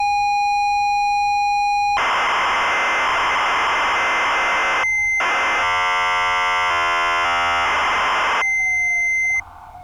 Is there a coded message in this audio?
Yes: ZX Spectrum tape loading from 0.0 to 9.4 s, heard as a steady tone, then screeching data, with street noise.